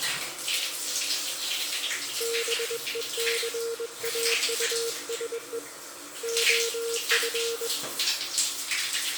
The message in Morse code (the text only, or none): BECAUSE OF